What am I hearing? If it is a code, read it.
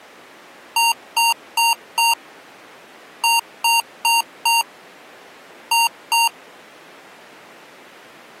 Beep code, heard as beeps from a small speaker, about 930 Hz. 4-4-2. In Phoenix BIOS tables: parallel port failure.